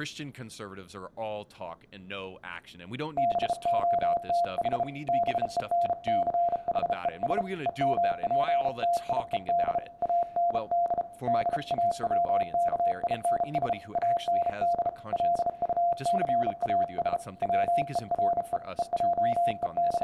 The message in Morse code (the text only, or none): BOTH BENCHES EMPTIED AND DAWKINS AND LUCAS WERE …